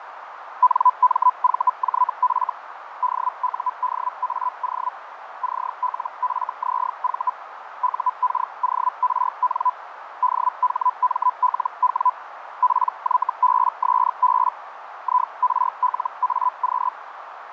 Hellschreiber (Feld-Hell, 122.5 baud), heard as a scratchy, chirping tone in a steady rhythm, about 1000 Hz, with radio static, fading and a narrow filter. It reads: NMVJF DUDAO CLFZV UKORN DHMLW PYBSB IRLAQ